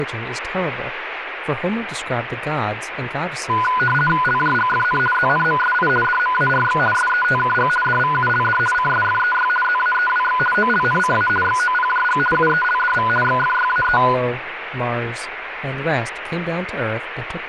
RTTY (50 baud, 450 Hz shift), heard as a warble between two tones, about 1230 Hz centre, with radio static and speech in English. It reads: LJGFN ZNMSI DMARX SETKG DVULD CSFEY ZAEWX OLNCA XOPJG UELDV XFYAE